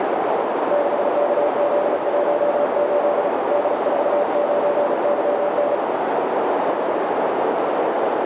Morse code, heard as a keyed tone, hand-sent with a paddle, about 36 wpm, 580 Hz, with heavy radio static and a narrow filter. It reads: 6KZ18 D49YN